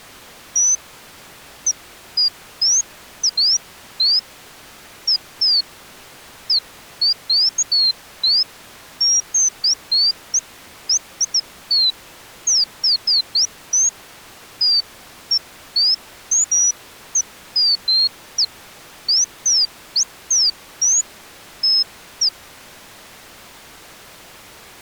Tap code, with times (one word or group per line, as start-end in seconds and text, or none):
none